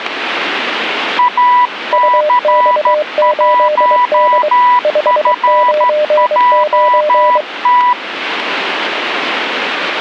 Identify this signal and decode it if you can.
Morse code, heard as two keyed tones, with radio static. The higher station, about 13 wpm, 980 Hz: AC1FJT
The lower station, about 23 wpm, 600 Hz: UX8D 599